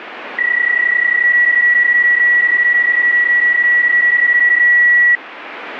PSK31 (31.25 baud), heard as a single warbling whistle, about 1950 Hz, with radio static.